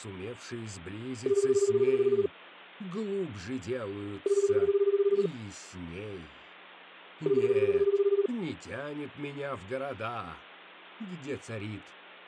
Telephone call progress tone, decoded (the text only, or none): ringback tone